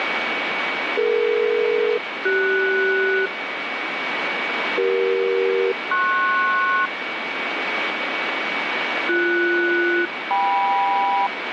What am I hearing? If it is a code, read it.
Aircraft SELCAL, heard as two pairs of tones, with radio static and a steady whistle near 2260 Hz. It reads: DE-CS CE-PS BS-KM